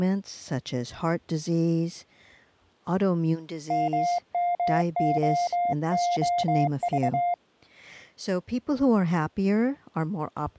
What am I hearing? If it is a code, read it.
Morse code, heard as a keyed tone, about 23 wpm, 700 Hz, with speech in English. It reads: MMOOV